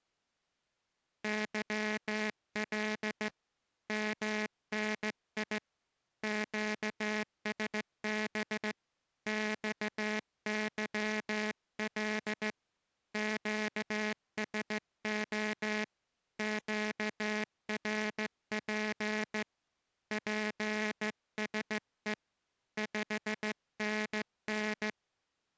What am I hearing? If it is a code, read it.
Morse code, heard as a buzzer, hand-sent with a straight key, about 15 wpm. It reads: YL MNI QSB XYL QSO QRP PSE 5NN